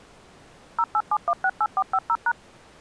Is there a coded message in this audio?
Yes: DTMF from 0.8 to 2.3 s, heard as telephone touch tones, dialled by machine, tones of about 60 ms. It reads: 087168450#